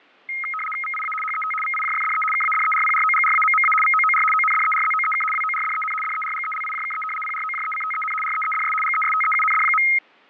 RTTY (75 baud, 850 Hz shift), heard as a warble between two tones, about 1700 Hz centre, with fading. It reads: VIA HET VIJFDE KADERPROGRAMMA VOOR ONDERZOEK WORDEN DERGELIJKE PROJECTEN REEDS GESTEUND.